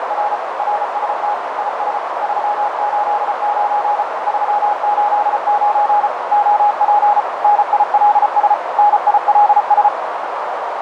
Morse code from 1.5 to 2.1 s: IS

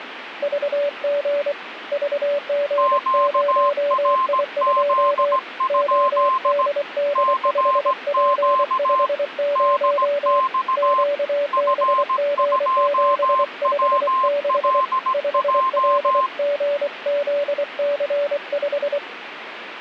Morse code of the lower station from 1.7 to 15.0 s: VG0I2 ODD5P50 QBG756

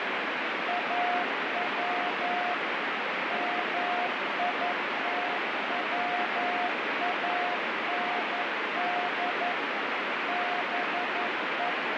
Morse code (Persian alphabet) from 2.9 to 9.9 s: میتواند

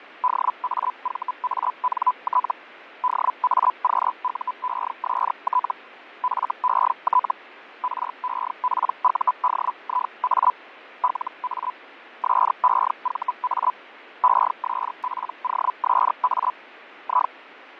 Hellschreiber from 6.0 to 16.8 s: FET REPUDIA LA SEVA ESPOSA

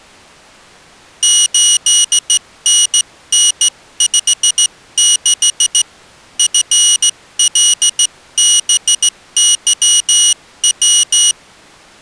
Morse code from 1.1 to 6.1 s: 8NN56

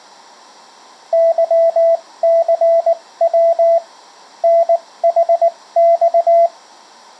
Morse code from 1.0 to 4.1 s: YCW

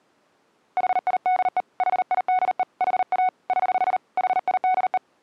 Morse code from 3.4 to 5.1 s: <HH> HIDE

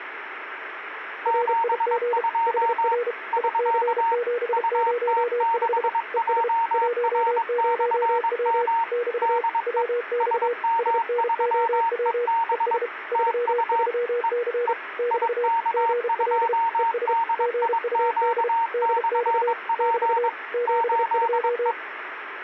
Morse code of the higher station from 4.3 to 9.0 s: UT6JR/M

